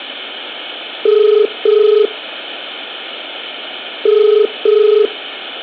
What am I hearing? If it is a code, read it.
Telephone call progress tone (as in the UK, Ireland, Australia and similar networks), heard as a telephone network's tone, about 430 Hz, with room echo. Ringback tone.